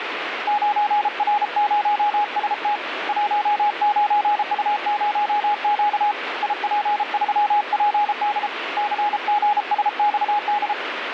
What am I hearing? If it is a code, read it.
Morse code, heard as a keyed tone, hand-sent with a paddle, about 33 wpm, 830 Hz, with radio static. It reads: 9R0ST 19U0Q IP3PD CGSXD